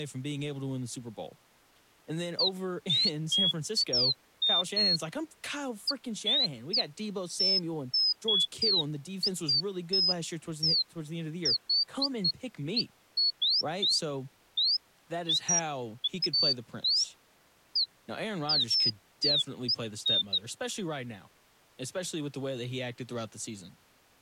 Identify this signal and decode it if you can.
Bird-like chirps, with speech in English. There is no code.